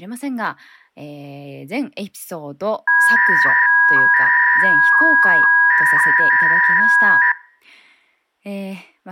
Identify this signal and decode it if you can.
300-baud modem data (V.21 tones), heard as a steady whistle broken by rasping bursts, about 300 baud, 200 Hz shift, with speech in Japanese.